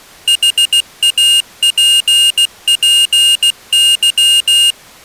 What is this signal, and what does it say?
Morse code, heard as a high beeper, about 16 wpm, 2850 Hz. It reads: HAPPY